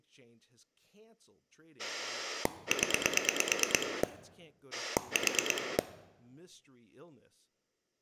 Pulse dialling, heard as a rotary dial, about 9 pulses a second, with speech in English. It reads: 0 4